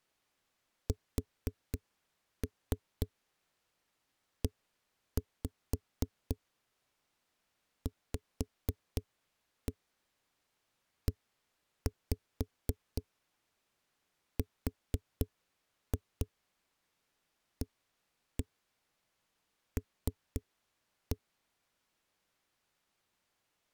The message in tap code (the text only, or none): SEVERAL